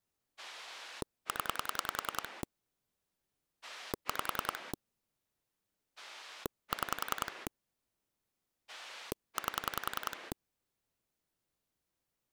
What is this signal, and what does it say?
Pulse dialling, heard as a rotary dial, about 10 pulses a second. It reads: 0 5 6 8